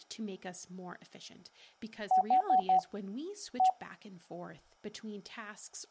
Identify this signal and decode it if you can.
Beep code, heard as beeps, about 750 Hz, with speech in English. 4-1.